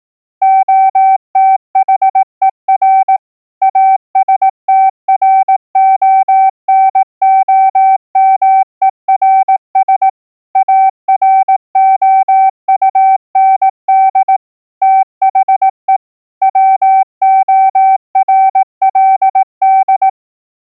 Morse code, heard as a keyed tone, machine-sent, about 18 wpm, 770 Hz. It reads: OTHER ASTRONOMERS AROUND THE WORLD